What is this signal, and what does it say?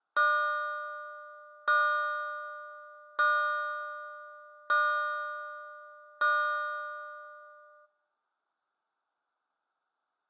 Clock strike, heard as a bell. 5. Five o'clock.